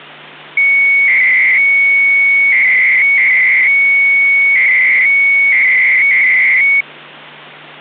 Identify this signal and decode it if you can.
300-baud modem data (Bell 103 tones), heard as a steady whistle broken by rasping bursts, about 300 baud, 200 Hz shift, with hum.